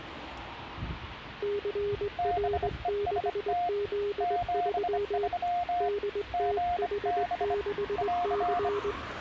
Morse code, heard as two keyed tones, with street noise. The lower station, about 20 wpm, 410 Hz: CR6Z3 DTH6C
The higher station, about 25 wpm, 710 Hz: BEST 73 GB <AR>